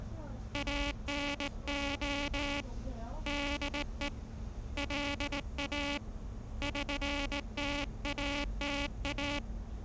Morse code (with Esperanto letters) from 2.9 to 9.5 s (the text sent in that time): DE LA ŜTATA